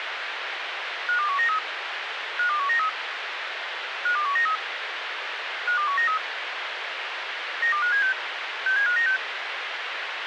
Five-tone selective call (CCIR), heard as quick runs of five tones, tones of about 100 ms, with radio hiss. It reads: 52193 52193 52193 52193 92576 67596